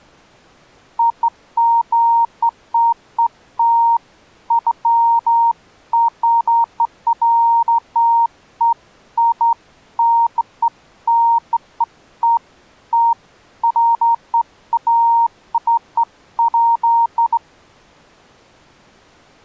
Beeps of irregular length. There is no code.